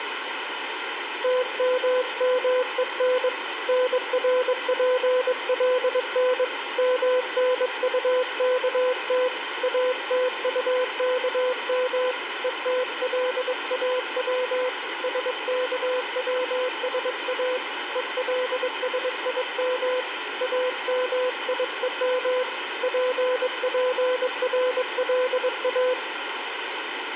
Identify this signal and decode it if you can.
Morse code, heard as a keyed tone, hand-sent with a paddle, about 22 wpm, 510 Hz, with radio static. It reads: TMMEN NRPLN MNUKT ATUKM ETLAW SKWSA ELSIM AMIEM PPRLA